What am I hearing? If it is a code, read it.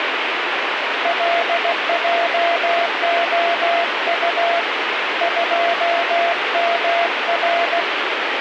Morse code, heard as a keyed tone, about 16 wpm, 680 Hz, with radio static. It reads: LJOU 2MR